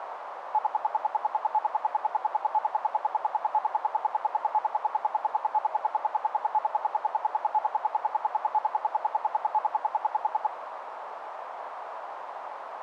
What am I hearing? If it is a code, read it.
Radio time signal (RWM, Moscow), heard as ten pulses a second, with radio static and a narrow filter.